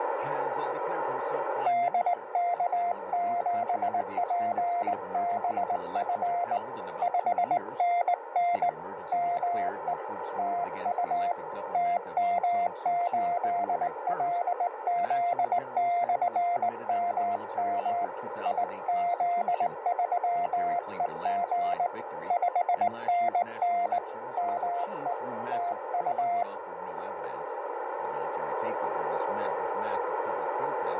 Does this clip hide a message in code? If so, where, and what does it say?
Yes: Morse code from 1.6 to 26.5 s, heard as a keyed tone, hand-sent with a straight key, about 19 wpm, 700 Hz, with radio static and a narrow filter. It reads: DK7PBF 5NN ME TU TM8LZ/MM IZ3EG 5NN ME TU